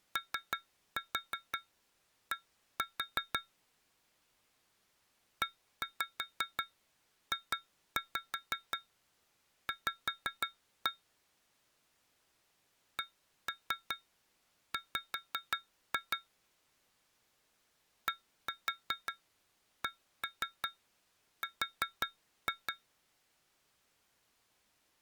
Tap code, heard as taps on glass, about 5 knocks a second. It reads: OD EJV CW DCR